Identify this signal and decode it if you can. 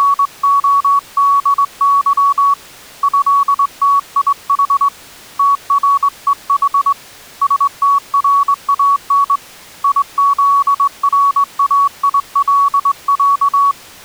Morse code (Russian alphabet), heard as a keyed tone, hand-sent with a straight key, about 21 wpm, 1120 Hz. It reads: … ЭТИХ ТРЕХ СТРАН ИЗРАИЛЯ